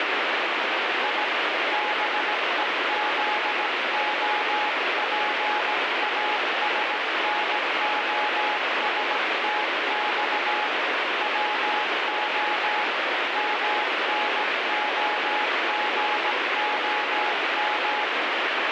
Morse code (Russian alphabet), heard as a keyed tone, hand-sent with a paddle, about 17 wpm, 840 Hz, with heavy radio static. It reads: И БЕЗОПАСНОСТЬ ВО МНОГОМ